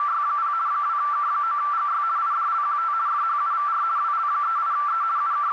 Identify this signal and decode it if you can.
RTTY (50 baud, 170 Hz shift), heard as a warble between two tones, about 1250 Hz centre, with radio static and a narrow filter. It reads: … 2K9GY IDLQT FHUVR WL38E …